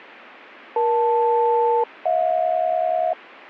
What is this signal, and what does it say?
Aircraft SELCAL, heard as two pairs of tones. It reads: EL-HJ